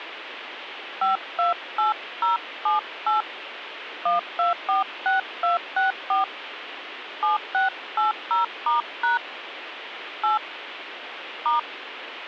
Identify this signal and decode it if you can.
DTMF, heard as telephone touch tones, dialled by hand, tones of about 140 ms, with radio hiss. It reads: 528078 1246264 7680*# 8 *